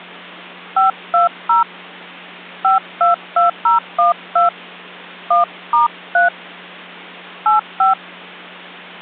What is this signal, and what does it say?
DTMF, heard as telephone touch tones, dialled by hand, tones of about 140 ms, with hum. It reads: 520 522012 1*3 85